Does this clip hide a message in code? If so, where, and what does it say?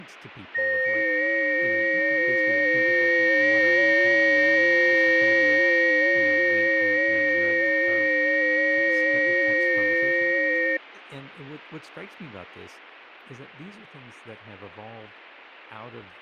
Yes: FT8 (several signals at once) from 0.5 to 10.8 s, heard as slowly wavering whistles, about 6.25 baud, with radio static and speech in English.